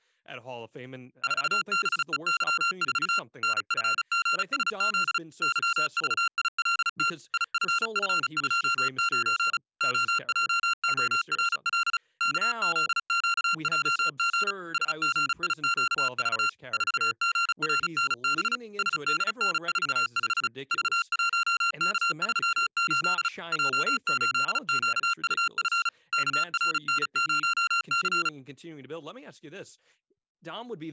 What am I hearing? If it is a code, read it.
Morse code, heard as electronic beeps, machine-sent, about 35 wpm, 1380 Hz, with speech in English. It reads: 4BEY4 NFGSZ YVILT IFF29 OJORL KZQJG SGIQV 4GRNB SDN45 V1K38 J8QUF KRN0C